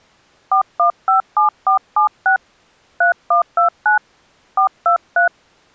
DTMF, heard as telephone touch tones, dialled by hand, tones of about 120 ms. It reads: 4157476 3129 423